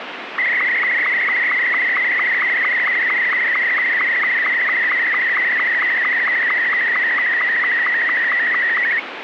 SSTV (slow-scan television), Martin M2, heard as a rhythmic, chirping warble, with radio static.